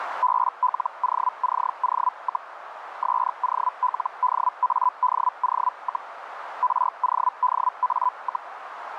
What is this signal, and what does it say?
Hellschreiber (Feld-Hell, 122.5 baud), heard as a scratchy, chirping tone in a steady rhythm, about 1000 Hz, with radio static and a narrow filter. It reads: BLOCO, SOLDADO, RODA,